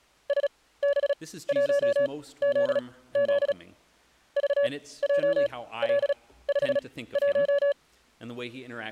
Morse code, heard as a keyed tone, machine-sent, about 36 wpm, spaced as for 18 wpm, 570 Hz. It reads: SB1ZZ VJL51